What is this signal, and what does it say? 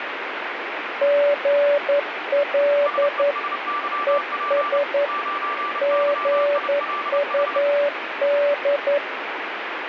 Morse code, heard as two keyed tones, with radio static. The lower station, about 11 wpm, 580 Hz: GL ES GUD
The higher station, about 30 wpm, 1170 Hz: SESYP 9YILH